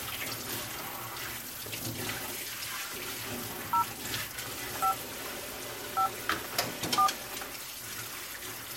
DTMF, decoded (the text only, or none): 0 5 5 4